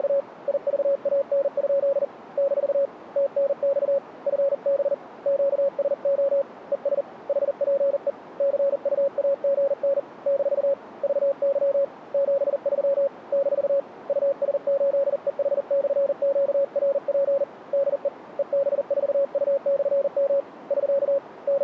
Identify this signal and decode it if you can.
Morse code, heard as a keyed tone, hand-sent with a paddle, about 40 wpm, 550 Hz, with radio static. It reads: … IVAN? - TNX FB QSO ES HPE CUAGN - VY 73 - US8EH/QRP DE EB4U/M <SK> …